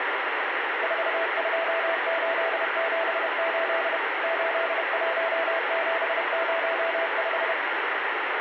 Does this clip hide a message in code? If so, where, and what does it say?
Yes: Morse code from 0.8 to 7.6 s, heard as a keyed tone, machine-sent, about 31 wpm, 660 Hz, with heavy radio static. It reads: 42878 81705